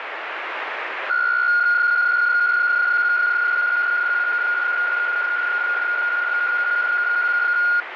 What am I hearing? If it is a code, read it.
PSK63 (62.5 baud), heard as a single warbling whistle, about 1430 Hz, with radio static.